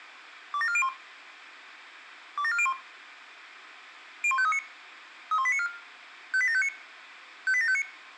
Five-tone selective call (ZVEI), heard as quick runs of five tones, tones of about 70 ms, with room echo. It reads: 27401 27401 01539 31894 58759 58759